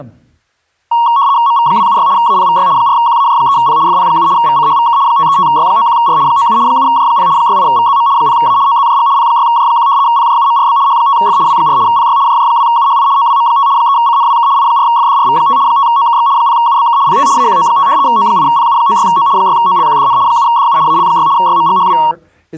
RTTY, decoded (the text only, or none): MV276 APVY 4QAJ3P FP7 VCHVK 535Y91R 97 7J0 68VZM 0A OZJG P6J1 PJUMRB H5F W4 PY JJ2UHI OWM5 3CNWK I4FDRV5 5OKX 0UBK PT AQO5 O8PU96O 6OLQDN 7DU AL6 YMGHW